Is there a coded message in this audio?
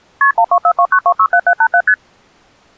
Yes: multi-frequency trunk signalling (R1, as on North American trunks) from 0.2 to 1.9 s, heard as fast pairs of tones, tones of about 70 ms. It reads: KP 12429267787 ST